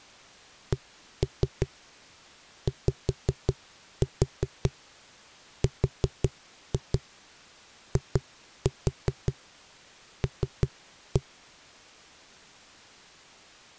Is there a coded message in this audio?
Yes: tap code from 0.7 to 11.2 s, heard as knocks on a wall, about 5 knocks a second. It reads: CYRIL